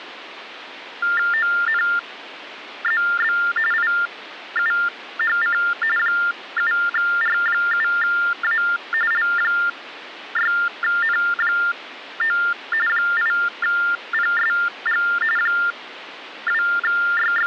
TTY/TDD text telephone tones (45.45 baud Baudot), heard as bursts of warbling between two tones, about 400 Hz shift, 1600 Hz centre, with phone line noise. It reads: ONZB IUHC 7R7A L6N9 8PSG …